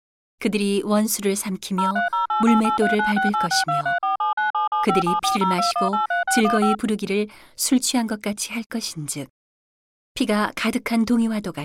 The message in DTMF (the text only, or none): 03088839686234797757402183615